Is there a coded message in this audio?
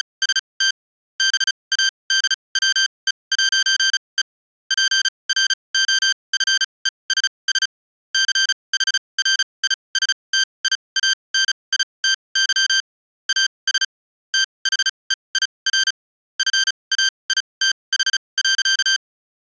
Yes: Morse code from 0.0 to 19.0 s, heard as electronic beeps, machine-sent, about 35 wpm, spaced as for 25 wpm, 1550 Hz. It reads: … BADWE'E PROFESS CHRISTIANITY AS THEIR FAITH.